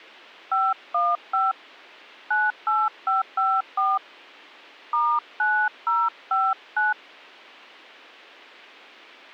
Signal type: DTMF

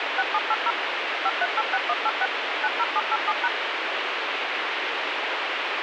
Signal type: DTMF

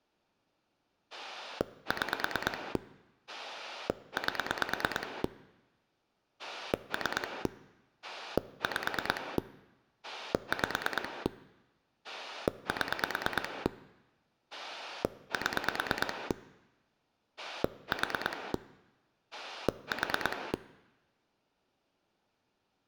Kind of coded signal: pulse dialling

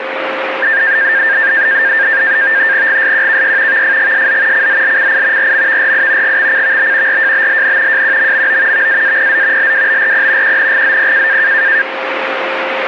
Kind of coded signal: NAVTEX (SITOR-B)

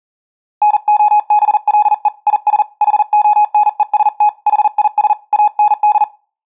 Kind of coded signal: Morse code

